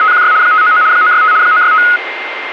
RTTY (75 baud, 170 Hz shift), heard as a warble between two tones, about 1360 Hz centre, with radio static and a steady whistle near 2100 Hz. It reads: … 599 965 965